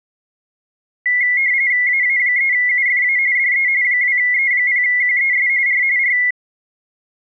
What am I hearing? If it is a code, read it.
RTTY (45.45 baud, 170 Hz shift), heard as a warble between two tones, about 2050 Hz centre. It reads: AA3UFA DE 2E0QES R R